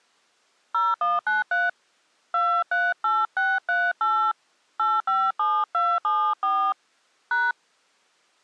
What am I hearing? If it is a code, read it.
DTMF, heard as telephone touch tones, dialled by hand, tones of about 230 ms. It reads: 0193 238638 857274 #